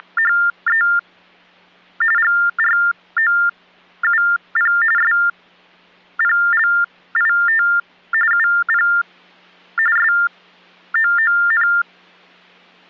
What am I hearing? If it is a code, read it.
TTY/TDD text telephone tones (45.45 baud Baudot), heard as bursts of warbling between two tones, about 400 Hz shift, 1600 Hz centre. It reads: … GROUP SPLIT UP SOON